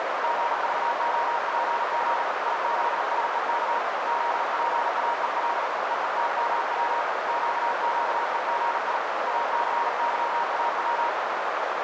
Morse code, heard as a keyed tone, hand-sent with a paddle, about 39 wpm, 940 Hz, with heavy radio static and a narrow filter. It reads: GVOPG IZSEK ZPAEL EETMW QQEGI ACYAW